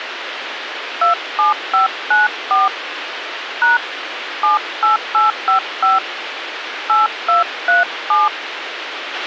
DTMF, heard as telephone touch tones, dialled by hand, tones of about 140 ms, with radio hiss and a squelch burst at the end. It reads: 27594 # 78855 8237